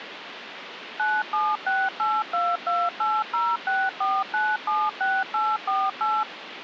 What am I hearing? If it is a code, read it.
DTMF, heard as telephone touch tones, dialled by machine, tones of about 220 ms, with phone line noise. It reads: 9768228064976848